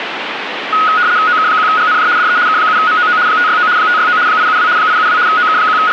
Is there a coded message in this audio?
Yes: RTTY (75 baud, 170 Hz shift) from 0.7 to 5.9 s, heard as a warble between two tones, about 1360 Hz centre, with radio static. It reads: OK1GNJ DE K7MOO 569 569 872 872 …